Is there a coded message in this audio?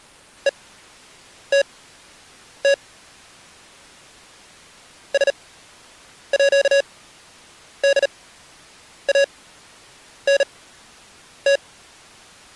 Yes: Morse code (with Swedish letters) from 0.4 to 11.6 s, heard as electronic beeps, machine-sent, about 38 wpm, spaced as for 8 wpm, 560 Hz. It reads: ETT SÅDANT